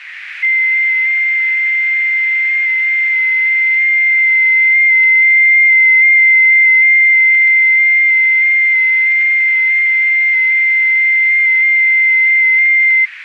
FT8 (one signal), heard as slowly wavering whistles, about 6.25 baud, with radio static and a narrow filter.